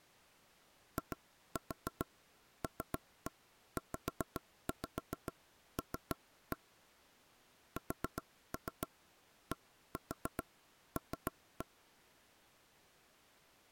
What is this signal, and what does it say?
Tap code, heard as knocks on wood, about 7 knocks a second. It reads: ILZL SDL